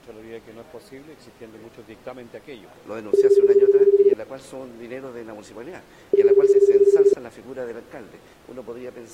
Telephone call progress tone (Japanese plan), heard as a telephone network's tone, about 380, 400, 420 Hz, 1 s on and 2 s off. Ringback tone.